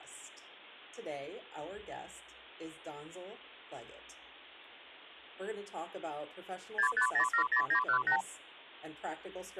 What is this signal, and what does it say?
Multi-frequency trunk signalling (R2, with the far end's replies), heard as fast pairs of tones, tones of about 90 ms. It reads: 65070918